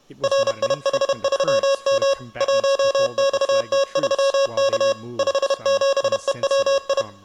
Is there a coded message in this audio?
Yes: Morse code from 0.2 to 7.1 s, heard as electronic beeps, machine-sent, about 31 wpm, 550 Hz, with speech in English. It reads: RIH3M 1XT3K 57EWI